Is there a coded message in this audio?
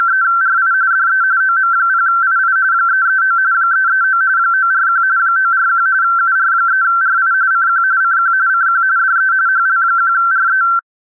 Yes: RTTY (45.45 baud, 170 Hz shift) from 0.0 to 10.8 s, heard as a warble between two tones, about 1450 Hz centre. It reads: … DE OM0II 339 339 941 941 UR3RI CQ CQ CQ DE HL1RE